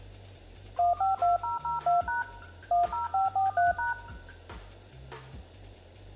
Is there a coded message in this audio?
Yes: DTMF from 0.8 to 3.9 s, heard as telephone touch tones, dialled by machine, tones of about 150 ms, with room echo. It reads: 152002# 10543#